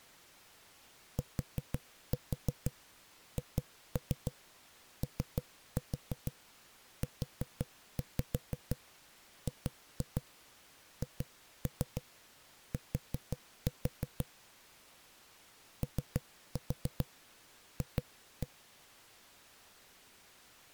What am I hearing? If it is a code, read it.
Tap code, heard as knocks on a wall, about 6 knocks a second. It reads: THOUGHT OF